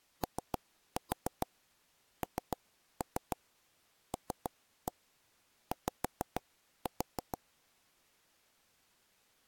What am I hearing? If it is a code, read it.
Tap code, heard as taps on a table, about 6 knocks a second. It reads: ONLY